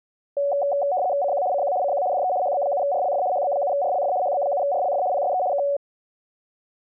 RTTY (75 baud, 170 Hz shift), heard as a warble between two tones, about 650 Hz centre. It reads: CQ CQ CQ DE HB7RLF HB7RLF HB7RLF PSE K